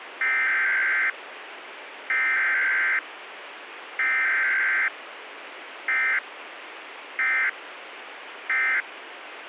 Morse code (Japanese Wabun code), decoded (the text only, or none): none